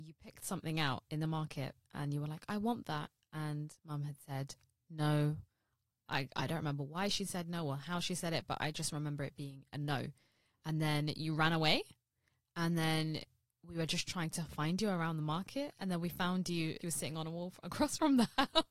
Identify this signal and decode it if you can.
Speech in English. There is no code.